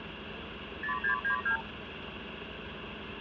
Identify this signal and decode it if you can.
Multi-frequency trunk signalling (R2, with the far end's replies), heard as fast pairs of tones, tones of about 100 ms, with phone line noise and street noise. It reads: 0692